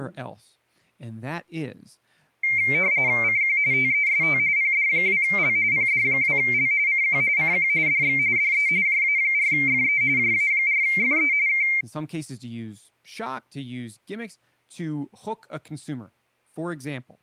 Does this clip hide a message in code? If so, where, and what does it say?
Yes: RTTY (45.45 baud, 170 Hz shift) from 2.4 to 11.8 s, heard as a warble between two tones, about 2200 Hz centre, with speech in English. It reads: CQ TEST PD2L PD2L CQ CQ DX DE JA4FE JA4FE K